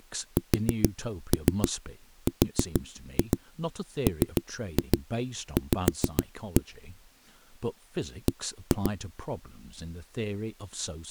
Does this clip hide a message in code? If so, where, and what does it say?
Yes: tap code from 0.4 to 8.9 s, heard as knocks on a wall, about 7 knocks a second, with speech in English. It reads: SRMV B